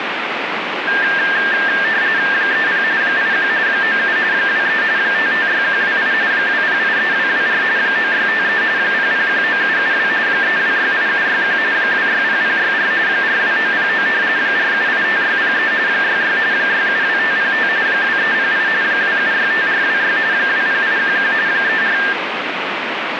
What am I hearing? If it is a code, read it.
RTTY (45.45 baud, 170 Hz shift), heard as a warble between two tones, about 1700 Hz centre, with radio static. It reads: 30 81 97 23 556128 2083224 9653 0019772 3268761 260064 42909 4785603 66 672505 2308 2765426 20811 34